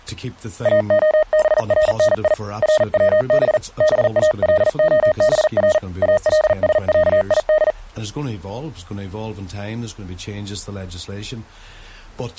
Morse code (Arabic alphabet), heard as a keyed tone, hand-sent with a paddle, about 40 wpm, 620 Hz. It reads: اخبرني روب بالخبر السعيد